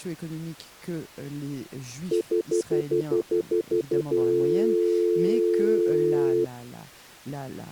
Telephone call progress tone (North American plan), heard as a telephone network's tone, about 350, 440 Hz, 0.1 s on and 0.1 s off, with speech in French. Stutter dial tone.